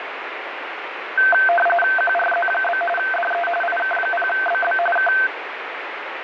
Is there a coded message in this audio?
Yes: RTTY (45.45 baud, 850 Hz shift) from 1.2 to 5.3 s, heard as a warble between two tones, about 1120 Hz centre, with radio static. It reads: QRZ? DE IK0BB K